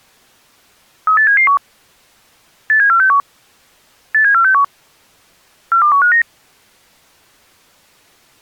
Five-tone selective call (CCIR), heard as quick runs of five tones, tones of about 100 ms. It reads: 38771 87461 87461 42159